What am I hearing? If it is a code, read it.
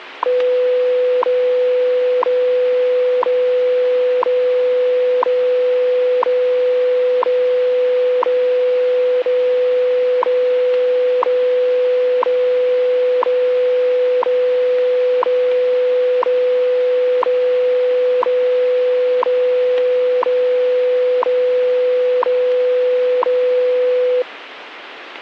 Radio time signal (WWV, Colorado), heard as ticks, one a second, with radio static.